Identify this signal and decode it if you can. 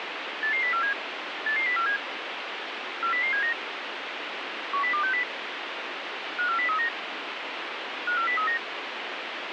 Five-tone selective call (CCIR), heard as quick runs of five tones, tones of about 100 ms, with radio hiss. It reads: 88047 88047 40079 10260 54039 54039